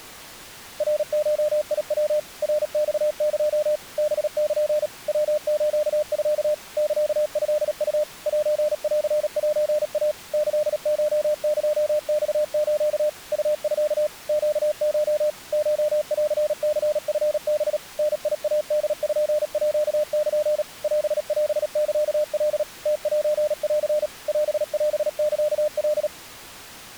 Morse code (Japanese Wabun code), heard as a keyed tone, machine-sent, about 37 wpm, 600 Hz. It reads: ナゴヤ ナマエ ハル ヤスミ サトウ センセイ キコエマス ウミ ネコ コンニチハ ダイポール オオサカ ムセン オオサカ